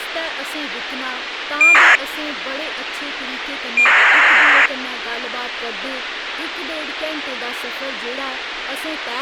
ACARS aircraft data, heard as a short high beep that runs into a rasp, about 2400 baud, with radio hiss and speech in Dogri.